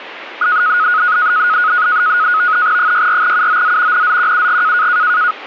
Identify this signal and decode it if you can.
NAVTEX (SITOR-B), 100 baud, 170 Hz shift, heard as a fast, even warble, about 1360 Hz centre. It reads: 64UOZ NZQUG